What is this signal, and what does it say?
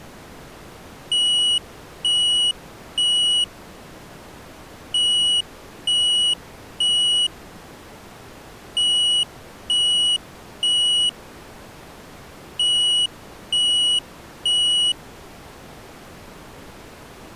Alarm pattern, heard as an alarm's beeps, played four times, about 2900 Hz. Temporal three. Smoke or fire, evacuate.